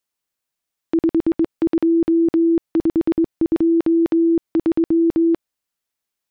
Morse code, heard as a keyed tone, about 23 wpm, 330 Hz. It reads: 52523